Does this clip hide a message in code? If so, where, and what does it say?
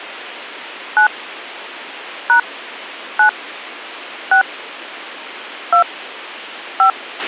Yes: DTMF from 1.0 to 6.9 s, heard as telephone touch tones, dialled by hand, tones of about 100 ms, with a squelch burst at the end. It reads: 9 # 9 6 2 5